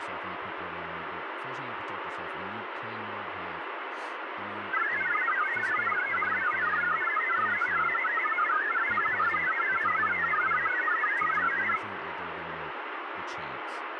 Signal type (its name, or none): multi-tone FSK (Olivia or MFSK type)